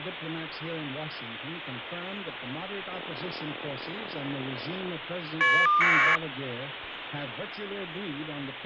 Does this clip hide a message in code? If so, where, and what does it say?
Yes: caller ID data burst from 2.9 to 6.2 s, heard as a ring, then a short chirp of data, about 1200 baud, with phone line noise.